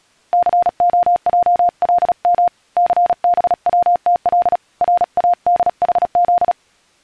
Morse code, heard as a keyed tone, hand-sent with a paddle, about 36 wpm, 700 Hz. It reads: COJLM CBWTL RADHZ